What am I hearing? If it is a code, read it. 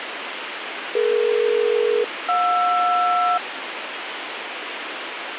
Aircraft SELCAL, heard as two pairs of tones, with radio hiss. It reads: DE-JR